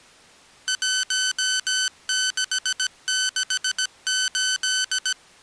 Morse code, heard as electronic beeps, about 17 wpm, 1500 Hz. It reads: 1668